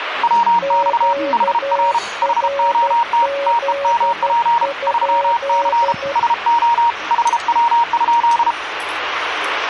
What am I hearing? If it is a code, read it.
Morse code, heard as two keyed tones, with radio static and the noise of a restaurant. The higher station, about 33 wpm, 940 Hz: WX HR HOT TEMP 3C SO HW?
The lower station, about 12 wpm, 560 Hz: QRZ?